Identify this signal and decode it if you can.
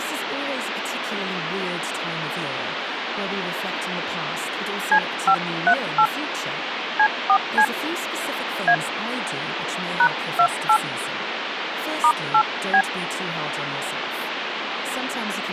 DTMF, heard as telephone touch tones, dialled by hand, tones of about 70 ms, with phone line noise and speech in English. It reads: C538 C4C A #28 *8B